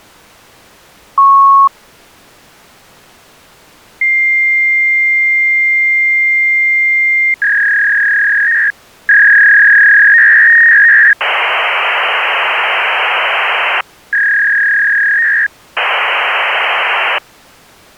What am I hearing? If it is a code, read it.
Fax machine handshake, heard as a beep, a long tone, a warble and hiss.